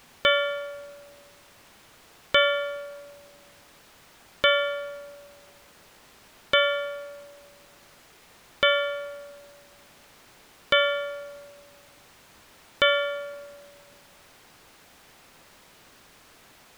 Clock strike, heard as a bell. 7. Seven o'clock.